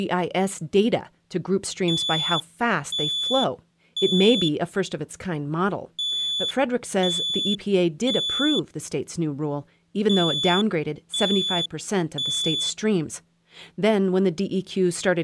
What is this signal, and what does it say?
Alarm pattern, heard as an alarm's beeps, played three times, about 3450 Hz, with speech in English. Temporal three. Smoke or fire, evacuate.